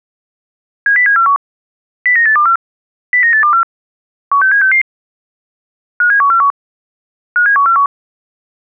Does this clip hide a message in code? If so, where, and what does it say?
Yes: five-tone selective call (CCIR) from 0.9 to 7.9 s, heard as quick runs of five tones, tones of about 100 ms. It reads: 70741 09824 09824 16766 57141 57141